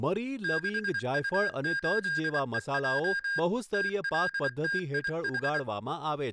Morse code, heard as electronic beeps, machine-sent, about 24 wpm, 1600 Hz, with speech in Gujarati. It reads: 6U8EJ TLTIH